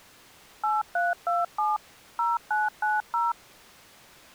DTMF, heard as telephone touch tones, dialled by machine, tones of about 180 ms. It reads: 8327 0990